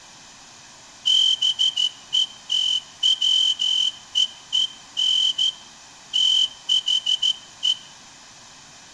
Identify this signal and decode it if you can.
Morse code, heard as a whistle, hand-sent with a straight key, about 14 wpm, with room echo. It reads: BETWEEN THE